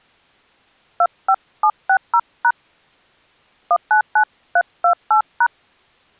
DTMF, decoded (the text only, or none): 25760# 199328#